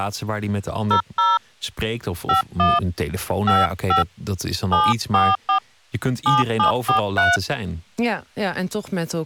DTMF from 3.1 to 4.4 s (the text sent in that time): 55